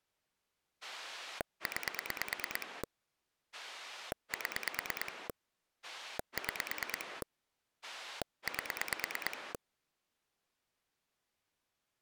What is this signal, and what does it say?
Pulse dialling, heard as a rotary dial, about 9 pulses a second. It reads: 9 7 6 8